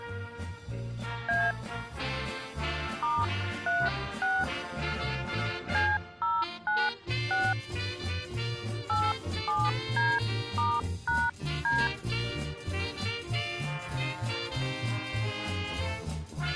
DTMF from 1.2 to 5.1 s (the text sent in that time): A *36